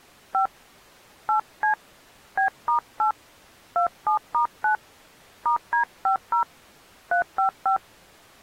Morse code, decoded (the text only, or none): none